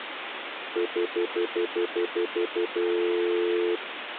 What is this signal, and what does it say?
Telephone call progress tone (North American plan), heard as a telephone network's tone, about 350, 440 Hz, 0.1 s on and 0.1 s off, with phone line noise. Stutter dial tone.